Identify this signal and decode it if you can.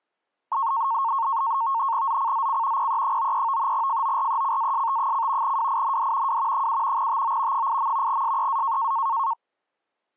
NAVTEX (SITOR-B), 100 baud, 170 Hz shift, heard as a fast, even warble, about 1000 Hz centre. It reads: ZCZC PE93 FORECAST: WIND W 7 TO 8. SEA